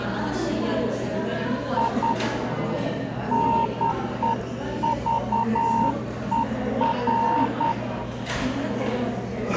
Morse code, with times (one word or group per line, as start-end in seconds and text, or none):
1.8-2.1 I
3.3-7.7 NEVER